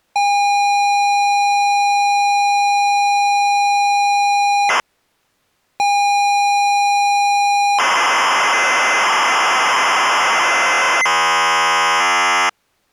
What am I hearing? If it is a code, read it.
ZX Spectrum tape loading, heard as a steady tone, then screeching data.